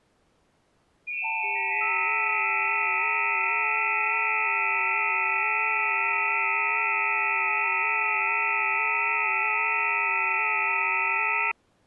FT8 (several signals at once), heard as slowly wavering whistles, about 6.25 baud.